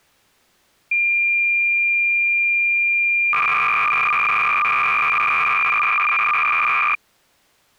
Cassette data (Kansas City type), 300 baud, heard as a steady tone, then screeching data.